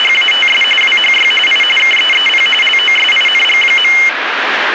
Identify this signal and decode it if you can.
RTTY (45.45 baud, 850 Hz shift), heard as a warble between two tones, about 2550 Hz centre, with radio static. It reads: … WHY I KEEP LOSING.